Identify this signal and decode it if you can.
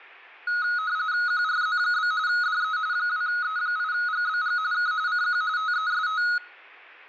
RTTY (45.45 baud, 170 Hz shift), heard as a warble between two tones, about 1360 Hz centre, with room echo. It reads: QRZ? DE 2E8GBG K CQ TEST